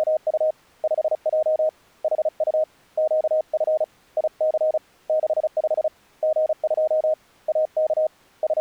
Morse code, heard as a keyed tone, hand-sent with a paddle, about 35 wpm, 620 Hz. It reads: … 5J HU QF IC 65 G2 AK …